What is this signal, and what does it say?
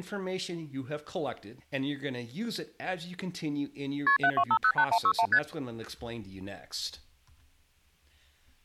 Multi-frequency trunk signalling (R1, as on North American trunks), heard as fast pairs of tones, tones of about 70 ms, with speech in English. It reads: KP 72508161 ST